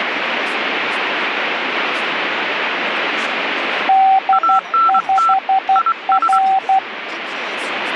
Morse code, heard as two keyed tones, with radio static and speech in Portuguese. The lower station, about 12 wpm, 770 Hz: D5R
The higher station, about 23 wpm, 1340 Hz: ANT IS